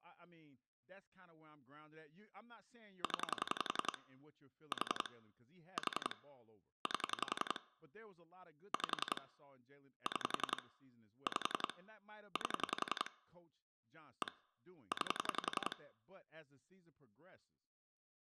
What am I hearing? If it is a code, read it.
Pulse dialling, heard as clicks on a phone line, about 11 pulses a second, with speech in English. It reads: 0 4 4 8 5 6 5 8 1 9